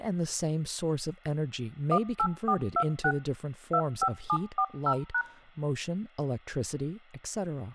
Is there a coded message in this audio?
Yes: DTMF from 1.9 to 5.2 s, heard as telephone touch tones, dialled by machine, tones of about 70 ms, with speech in English. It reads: 18426 25740#